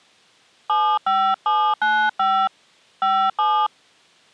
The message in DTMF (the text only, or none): 75795 57